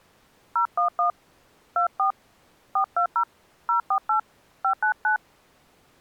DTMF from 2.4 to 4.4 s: 420 048

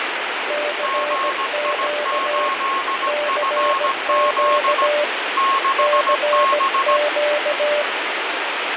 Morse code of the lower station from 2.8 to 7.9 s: CQ CQ

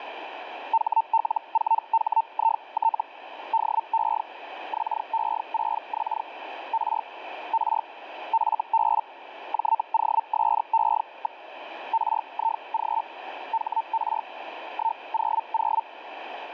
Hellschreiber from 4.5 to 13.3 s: XE6X R R FB JOSE. RIG

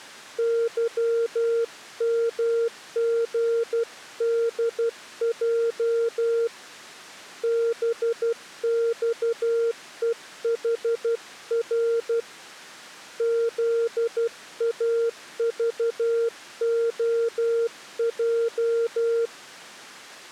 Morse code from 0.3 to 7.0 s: YMGDJ

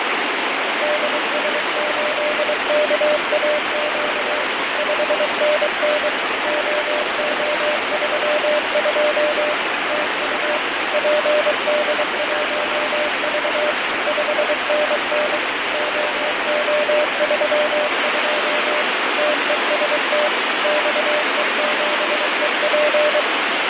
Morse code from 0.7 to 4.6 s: DS8KAQ

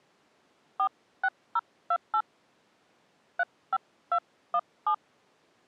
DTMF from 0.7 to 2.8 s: 46028

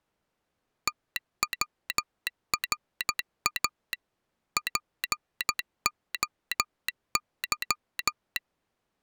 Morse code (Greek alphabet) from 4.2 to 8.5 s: ΠΟΥ

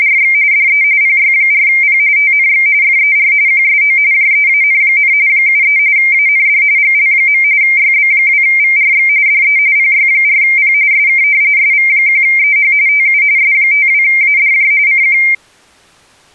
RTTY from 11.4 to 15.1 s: SV1EH TU S52ADJ CQ

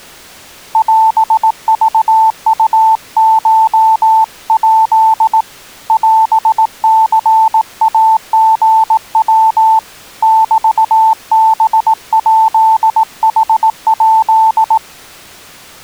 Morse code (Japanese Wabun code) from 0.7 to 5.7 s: オクウコヱ

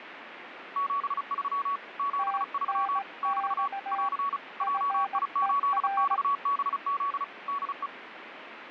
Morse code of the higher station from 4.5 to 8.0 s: JI8XBZ DE

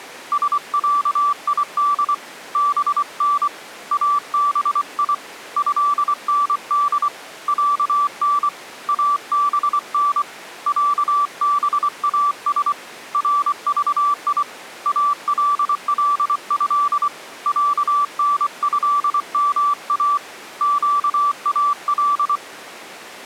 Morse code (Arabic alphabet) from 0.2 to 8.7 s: سعيد بن ابي هند عن

